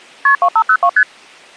Multi-frequency trunk signalling (R1, as on North American trunks), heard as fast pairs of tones, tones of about 70 ms. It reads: KP 2502 ST